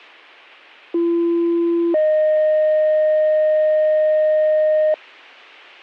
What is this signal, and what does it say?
Two-tone page, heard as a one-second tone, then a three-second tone, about 340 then 620 Hz.